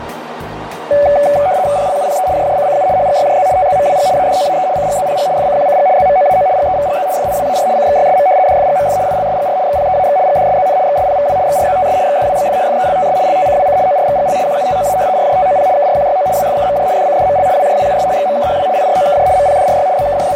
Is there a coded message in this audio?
Yes: RTTY (75 baud, 170 Hz shift) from 0.9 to 20.4 s, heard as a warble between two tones, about 660 Hz centre, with radio static and a narrow filter. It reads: PLUPE JJCCU HGYJZ TZMWG ADOAE CGZPG FCQCG ZMOAO GEVGZ FIWAR CXYSM DFGMF ILSGR XPEAX GDSZN XSPVW XRZTS XDWBF FELTS LTCWC ORXGL QUTOA RJTOP KRQYO WFKMJ DCDML WJWUS XMKHW IROKJ MPDRY …